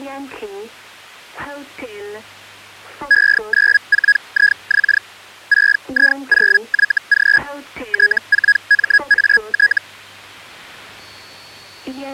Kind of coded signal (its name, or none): Hellschreiber